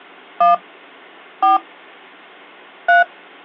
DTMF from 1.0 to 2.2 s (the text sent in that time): 4